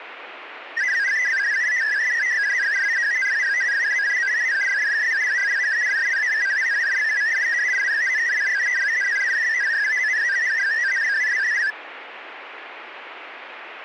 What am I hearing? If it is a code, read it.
Multi-tone FSK (Olivia or MFSK type), about 500 Hz wide, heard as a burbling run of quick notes, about 62.5 baud.